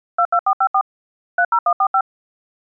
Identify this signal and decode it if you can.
DTMF, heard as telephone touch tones, dialled by machine, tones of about 70 ms. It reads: 22454 30145